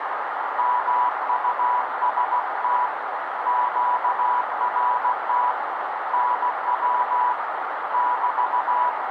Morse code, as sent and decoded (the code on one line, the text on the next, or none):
-- ..- ... - / --.- .-. - / -. .-- / -...-
MUST QRT NW <BT>